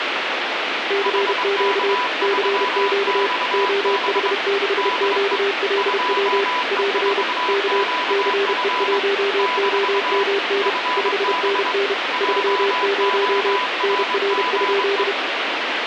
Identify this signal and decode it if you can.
Morse code, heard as two keyed tones, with radio static. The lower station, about 31 wpm, 400 Hz: CQ CQ OH6QLW <AR> K CE1OMN 5NN 30 NR?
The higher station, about 23 wpm, 990 Hz: HK3XB DE 2E4QF - FB JORGE